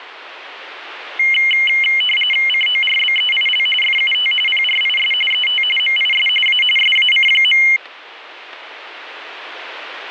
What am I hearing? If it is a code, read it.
RTTY (45.45 baud, 850 Hz shift), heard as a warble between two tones, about 2550 Hz centre, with radio static. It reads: CORBEIL FUT PRIS ET MIS A SAC.